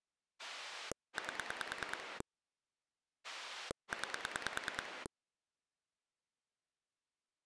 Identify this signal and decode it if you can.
Pulse dialling, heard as a rotary dial, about 9 pulses a second. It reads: 8 9